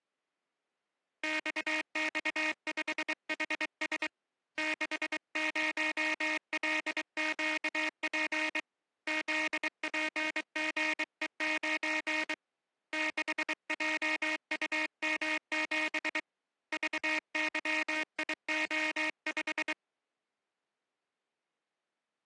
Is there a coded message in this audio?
Yes: Morse code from 1.2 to 19.8 s, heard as a buzzer, hand-sent with a bug key, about 23 wpm. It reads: XX5HS 60LQP ZPGE9 6JUM7 VYIO5